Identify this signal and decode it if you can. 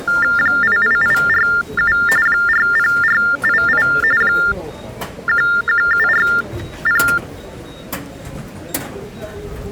TTY/TDD text telephone tones (45.45 baud Baudot), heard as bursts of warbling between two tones, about 400 Hz shift, 1600 Hz centre, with the noise of a subway station. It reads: 88847 40488 11740